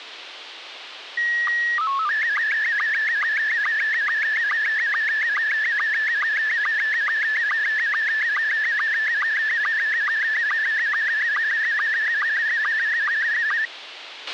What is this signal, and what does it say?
SSTV (slow-scan television), Scottie S1, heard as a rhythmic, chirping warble, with radio hiss and a squelch burst at the end.